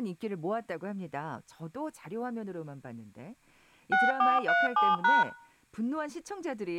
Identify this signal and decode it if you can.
DTMF, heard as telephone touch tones, dialled by machine, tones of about 190 ms, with room echo and speech in Korean. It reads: 6437#